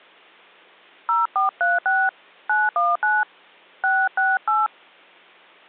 DTMF, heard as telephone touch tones, dialled by hand, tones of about 190 ms. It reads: 0436 919 668